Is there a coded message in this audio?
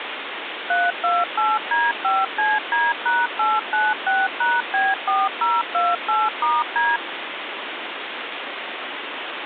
Yes: DTMF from 0.7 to 7.0 s, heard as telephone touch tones, dialled by machine, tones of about 200 ms, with phone line noise. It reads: 328D5CD#896#B4028*D